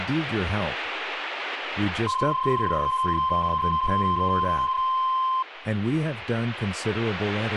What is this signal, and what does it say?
PSK31 (31.25 baud), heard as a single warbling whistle, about 1040 Hz, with speech in English.